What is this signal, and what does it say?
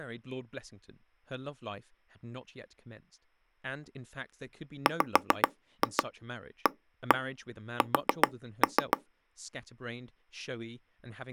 Tap code, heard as knocks on wood, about 7 knocks a second, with speech in English. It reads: WAS